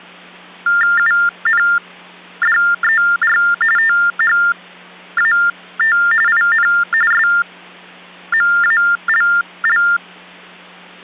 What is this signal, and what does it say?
TTY/TDD text telephone tones (45.45 baud Baudot), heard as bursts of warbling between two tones, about 400 Hz shift, 1600 Hz centre, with hum. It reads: UNDER THAT IN SMALL